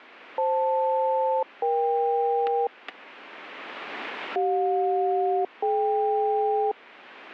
Aircraft SELCAL, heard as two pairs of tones, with static crashes. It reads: FL-EK CJ-DK